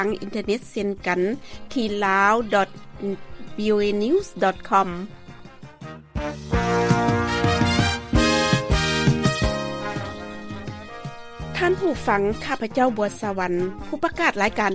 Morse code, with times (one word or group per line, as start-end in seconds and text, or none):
none